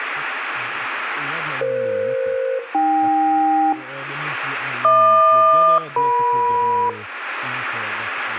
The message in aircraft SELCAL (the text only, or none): EF-AK HQ-EM